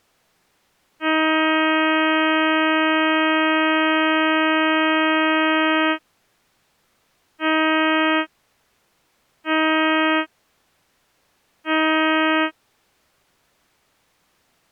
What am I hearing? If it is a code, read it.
Ship horn signal, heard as a ship's horn, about 320 Hz. 1 long, 3 short. At sea: a vessel under tow in fog.